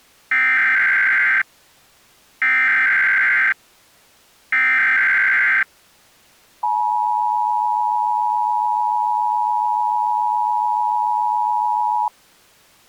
Emergency Alert System (SAME) tones (header bursts, then the 853 and 960 Hz attention tone), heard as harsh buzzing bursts, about 520.83 baud.